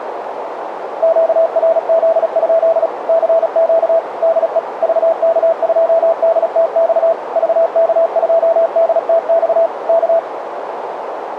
Morse code, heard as a keyed tone, machine-sent, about 36 wpm, 660 Hz, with radio static and a narrow filter. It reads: QRZ? CQ DE VK2DTX VK2DTX K